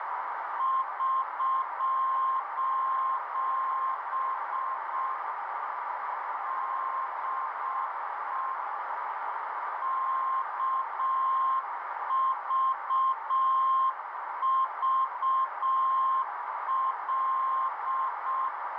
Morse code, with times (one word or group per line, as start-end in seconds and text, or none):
0.6-5.1 <SOS>
6.5-8.5 DE
9.8-18.5 KVVL